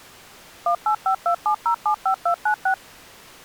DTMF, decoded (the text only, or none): 18527075296